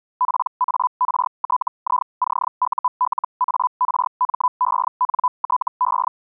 Hellschreiber (Feld-Hell, 122.5 baud), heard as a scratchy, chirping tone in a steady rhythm, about 1000 Hz. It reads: PARTICULARMENTE